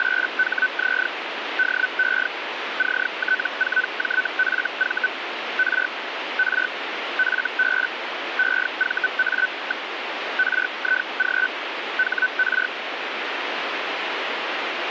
Hellschreiber (Feld-Hell, 122.5 baud), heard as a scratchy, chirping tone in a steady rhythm, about 1500 Hz, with radio static. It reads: … DE CT4JFV R R FB EVA. RIG HR